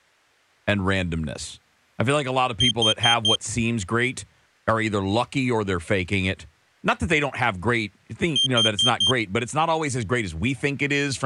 Alarm pattern, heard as an alarm's beeps, played twice, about 3150 Hz, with speech in English. Temporal four. Carbon monoxide.